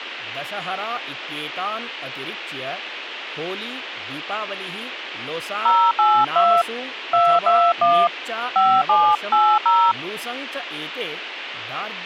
DTMF, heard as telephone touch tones, dialled by hand, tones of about 260 ms, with speech in Sanskrit. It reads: 082 221 5780